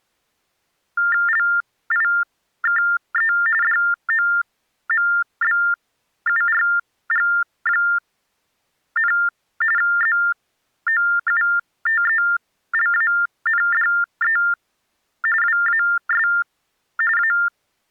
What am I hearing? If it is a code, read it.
TTY/TDD text telephone tones (45.45 baud Baudot), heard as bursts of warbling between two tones, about 400 Hz shift, 1600 Hz centre. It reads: LIKE DOMBURG, ZOUTELANDE WAS A